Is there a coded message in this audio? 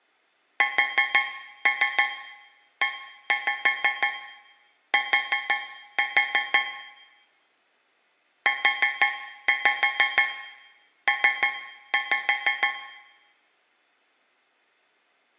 Yes: tap code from 0.6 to 12.9 s, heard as taps on a metal pipe, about 6 knocks a second, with room echo. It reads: SET UP